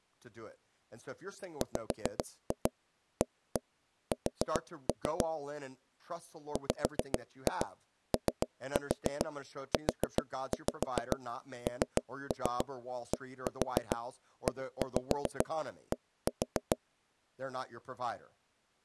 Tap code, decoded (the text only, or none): WAS WOUNDED